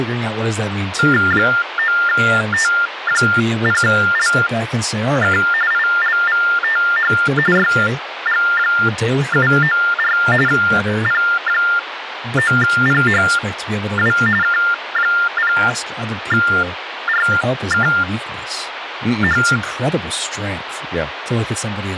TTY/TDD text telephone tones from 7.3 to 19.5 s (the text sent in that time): YG794 P9PHW K0RKH